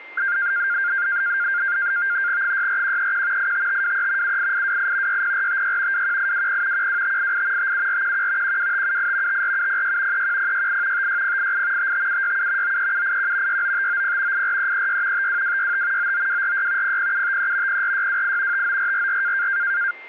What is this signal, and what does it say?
NAVTEX (SITOR-B), 100 baud, 170 Hz shift, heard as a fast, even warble, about 1500 Hz centre, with a steady whistle near 2100 Hz. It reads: 64131 85523 78828 60456 21820 12588 57411 12578 54706 31068 56088 55767 93781 69590 84336 52265 99246 00753 04628 59444